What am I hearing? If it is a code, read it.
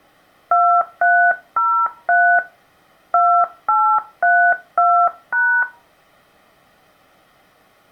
DTMF, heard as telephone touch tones, dialled by hand, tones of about 300 ms. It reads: 2303 2832#